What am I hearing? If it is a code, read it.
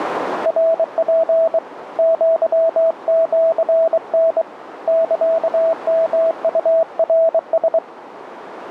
Morse code (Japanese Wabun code), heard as a keyed tone, hand-sent with a bug key, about 23 wpm, 650 Hz, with radio static and a narrow filter. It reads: ナツ アシタ サヨウナラ